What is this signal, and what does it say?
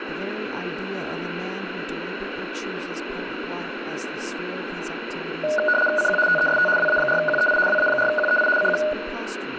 RTTY (75 baud, 850 Hz shift), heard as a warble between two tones, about 1040 Hz centre, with radio static, room echo and speech in English. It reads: CQ TEST WA4QEI WA4QEI CQ